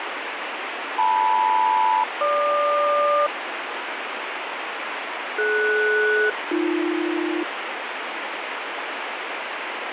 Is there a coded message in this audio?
Yes: aircraft SELCAL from 1.0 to 7.4 s, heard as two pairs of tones, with radio static. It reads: LM-GQ DS-AB